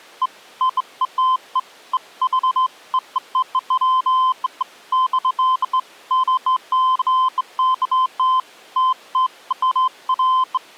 Beeps of irregular length. There is no code.